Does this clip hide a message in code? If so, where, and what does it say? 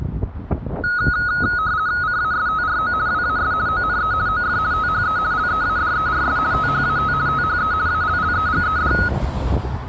Yes: RTTY (50 baud, 170 Hz shift) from 0.8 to 9.1 s, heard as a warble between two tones, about 1360 Hz centre, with street noise. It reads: CASTRO WAS ONE OF THE LEADERS THAT THE ALLEGED